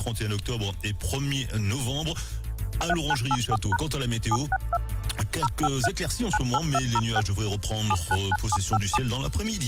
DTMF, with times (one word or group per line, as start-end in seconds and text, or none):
2.9-3.8 3984#
4.3-4.8 762
5.4-5.9 053
6.3-7.2 98206
7.9-9.0 799757